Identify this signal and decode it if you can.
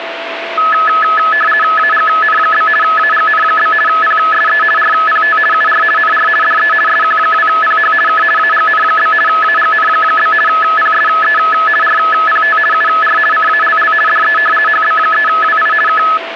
RTTY (50 baud, 450 Hz shift), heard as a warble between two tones, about 1500 Hz centre, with radio static and a steady whistle near 670 Hz. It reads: AGN? AGN? PSE RPT UR NR DE SQ2PH K AGN? AGN? PSE RPT UR CALL DE HB3WI K